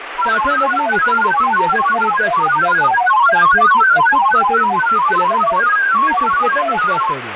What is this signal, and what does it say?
Multi-tone FSK (Olivia or MFSK type), about 1000 Hz wide, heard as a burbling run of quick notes, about 31.25 baud, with radio static and speech in Marathi.